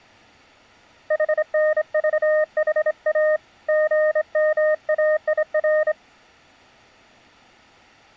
Morse code, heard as a keyed tone, hand-sent with a straight key, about 25 wpm, 620 Hz. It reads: HNVHA GMAIR